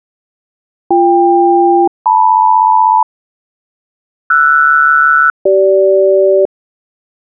Aircraft SELCAL, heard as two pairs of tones. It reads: BK-LM RS-CG